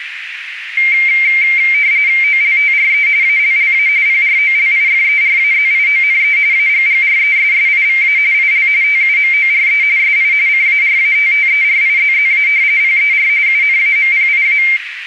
RTTY (45.45 baud, 170 Hz shift), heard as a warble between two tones, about 2200 Hz centre, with radio static and a narrow filter. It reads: OLTRE ALLA PROLIFERAZIONE AGGRESSIVA IL TUMORE SI CARATTERIZZA PER UNAMPIA